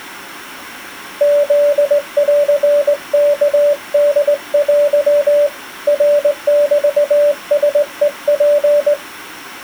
Morse code (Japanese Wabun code), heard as a keyed tone, hand-sent with a straight key, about 19 wpm, 580 Hz. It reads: フンワホテ ナメラヘツ